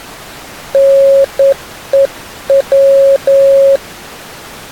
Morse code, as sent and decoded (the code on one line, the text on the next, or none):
-. . .--
NEW